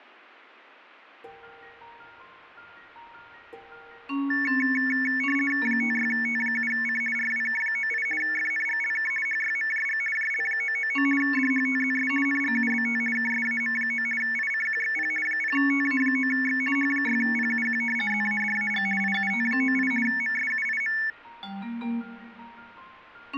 RTTY (50 baud, 450 Hz shift), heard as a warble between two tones, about 2000 Hz centre. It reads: 56T7C RWK98 FNGLK HYMJG JL999 DHTZS NGUBT KSAM9 ICQXP 0TA9X H6PUQ ZADAG IUT98 MSUIM